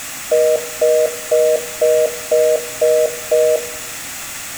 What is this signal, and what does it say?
Telephone call progress tone (North American plan), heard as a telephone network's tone, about 480, 620 Hz, 0.25 s on and 0.25 s off, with room echo. Congestion tone.